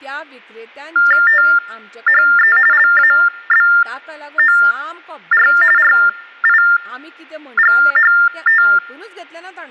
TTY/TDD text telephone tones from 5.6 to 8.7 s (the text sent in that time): RIGHT